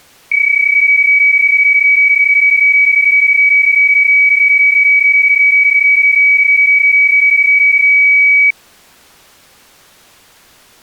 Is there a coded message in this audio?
Yes: PSK31 (31.25 baud) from 0.3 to 8.5 s, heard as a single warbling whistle, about 2250 Hz.